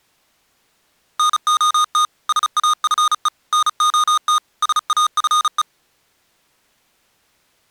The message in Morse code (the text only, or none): NOT SAFE NOT SAFE